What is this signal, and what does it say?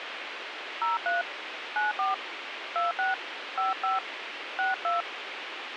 DTMF, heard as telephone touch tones, dialled by hand, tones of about 150 ms, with radio hiss. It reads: 03 94 26 55 62